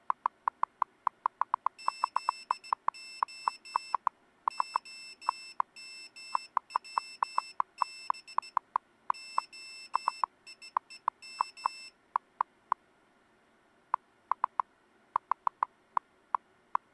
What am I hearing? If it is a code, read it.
Morse code (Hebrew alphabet), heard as a high beeper, hand-sent with a straight key, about 17 wpm, 2650 Hz. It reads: זה המצב היום